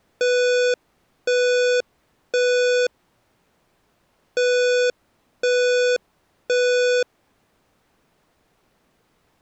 Alarm pattern, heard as an alarm's beeps, played twice, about 490 Hz. Temporal three. Smoke or fire, evacuate.